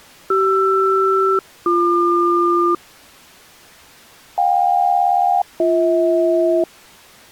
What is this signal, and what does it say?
Aircraft SELCAL, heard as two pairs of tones. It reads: CR-BQ JK-BH